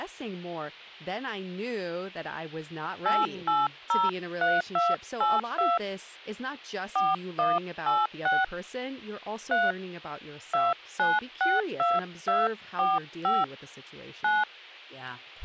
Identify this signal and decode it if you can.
DTMF, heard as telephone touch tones, dialled by hand, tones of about 190 ms, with speech in English. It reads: 8803282 4186 3 2962245 9